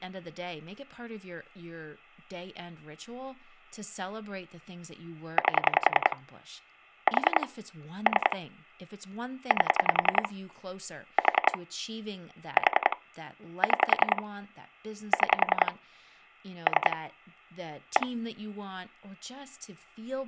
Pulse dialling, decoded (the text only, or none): 8 4 3 8 4 4 6 6 3 1